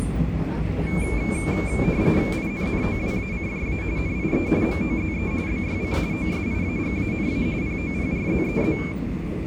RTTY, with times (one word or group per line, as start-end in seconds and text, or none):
2.3-3.8 INNOWACJA
4.0-4.5 NIE
4.6-5.3 MOZE
5.5-6.0 BYC
6.1-7.5 OSIAGANA
7.6-8.8 POPRZEZ